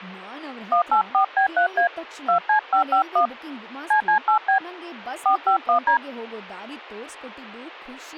DTMF, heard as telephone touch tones, dialled by hand, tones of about 100 ms, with speech in Kannada. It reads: 184B3A 2C551 CC8B 451D